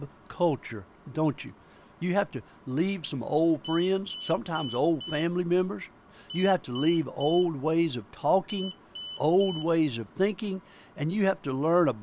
Beep code, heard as a piezo beeper, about 3000 Hz, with speech in English. 4-3-3. In Phoenix BIOS tables: timer channel 2 failure.